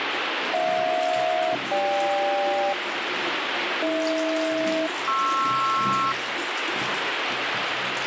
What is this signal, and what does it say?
Aircraft SELCAL, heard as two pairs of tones, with radio static and the noise of a restroom. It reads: HJ-GK AH-PR